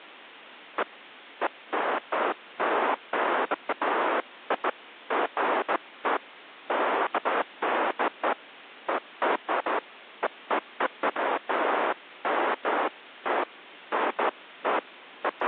Bursts of noise. There is no code.